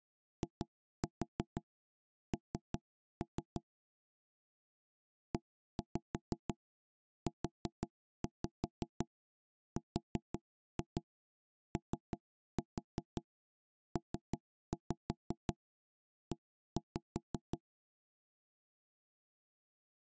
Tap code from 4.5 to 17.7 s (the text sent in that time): EUROPE